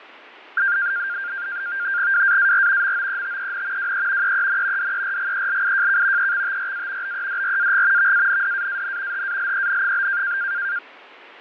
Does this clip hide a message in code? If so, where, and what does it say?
Yes: NAVTEX (SITOR-B), 100 baud, 170 Hz shift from 0.6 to 10.8 s, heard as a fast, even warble, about 1500 Hz centre, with radio static and fading. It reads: WAAR MOETEN WE EEN DERGELIJK EXTRA BEDRAG VANDAAN HALEN?